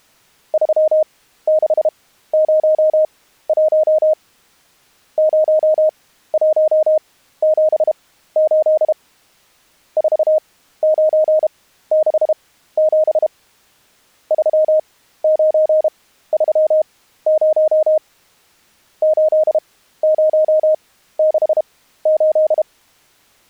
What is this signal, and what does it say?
Morse code, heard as a keyed tone, machine-sent, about 32 wpm, spaced as for 15 wpm, 620 Hz. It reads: 3601 0178 4967 3930 8068